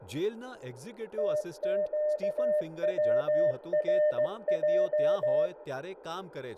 Morse code (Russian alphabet), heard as a keyed tone, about 16 wpm, 600 Hz, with room echo and speech in Gujarati. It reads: ТЩВРЙ